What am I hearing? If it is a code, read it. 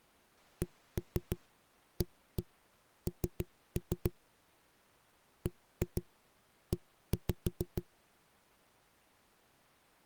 Tap code, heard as knocks on a wall, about 6 knocks a second. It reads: CAN BE